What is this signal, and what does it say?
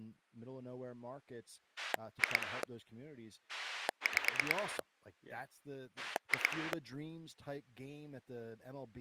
Pulse dialling, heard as a rotary dial, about 9 pulses a second, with speech in English. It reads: 2 5 2